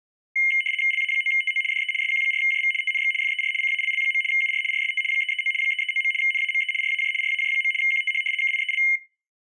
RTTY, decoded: LA9TO DE SQ4JV TNX FER CALL. UR RST 339 339. NAME RAJ RAJ. QTH KIEL

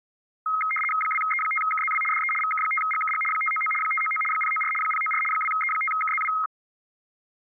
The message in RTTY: 2E5KZW DE VK5GKG 599 599 094 094 2E5KZW

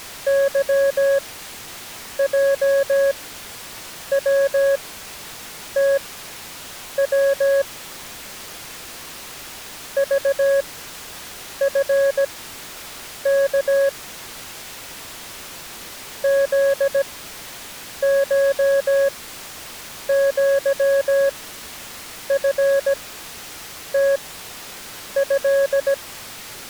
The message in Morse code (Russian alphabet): ЫЙВТВ ЖФК ЗШЪФТЭ

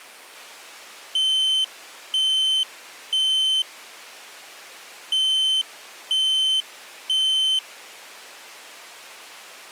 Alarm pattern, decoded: temporal three

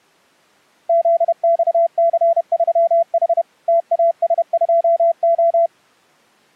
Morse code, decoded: ZXC3H TAS2O

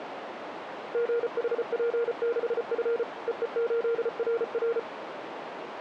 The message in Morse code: GHP6F EE8RR

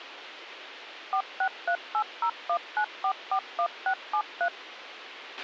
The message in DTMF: 4638019441673

